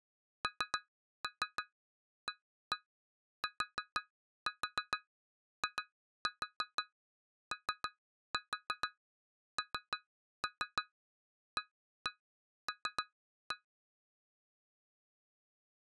Tap code, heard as taps on glass, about 6 knocks a second. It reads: NATIONAL